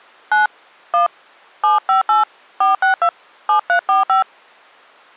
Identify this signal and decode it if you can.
DTMF, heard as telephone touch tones, dialled by hand, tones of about 110 ms. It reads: 9 1 758 462 7345